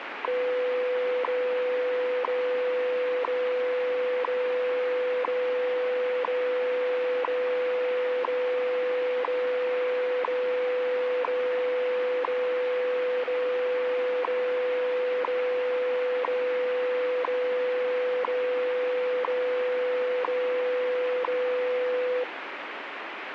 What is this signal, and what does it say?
Radio time signal (WWV, Colorado), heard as ticks, one a second, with radio static.